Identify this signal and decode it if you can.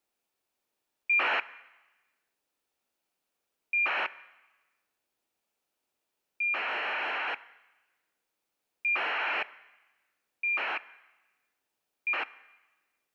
ACARS aircraft data, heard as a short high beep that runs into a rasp, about 2400 baud.